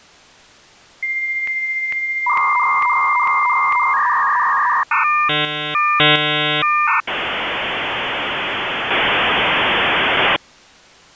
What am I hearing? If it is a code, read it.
Dial-up modem handshake (V.34 or later), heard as a whistle, warbles, then hiss.